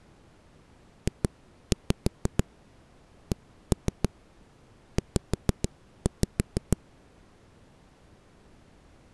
Tap code, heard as knocks on a wall, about 6 knocks a second. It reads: JCZ